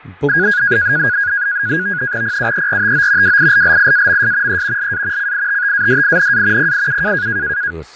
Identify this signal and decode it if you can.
NAVTEX (SITOR-B), 100 baud, 170 Hz shift, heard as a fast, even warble, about 1550 Hz centre, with fading and speech in Kashmiri. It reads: PUERTO WILLIAMS E LA CITTADINA PIU